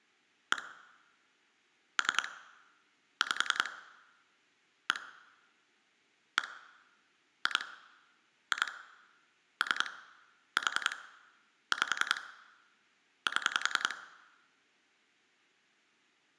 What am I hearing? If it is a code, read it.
Pulse dialling, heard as clicks on a phone line, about 10 pulses a second. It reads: 1 3 5 1 1 2 2 3 4 5 7